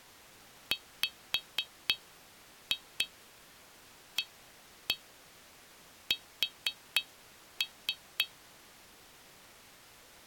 Tap code, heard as taps on glass, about 4 knocks a second. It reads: WAS